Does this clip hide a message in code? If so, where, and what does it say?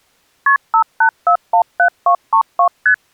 Yes: multi-frequency trunk signalling (R1, as on North American trunks) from 0.5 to 2.9 s, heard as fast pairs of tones, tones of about 90 ms. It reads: KP 58417232 ST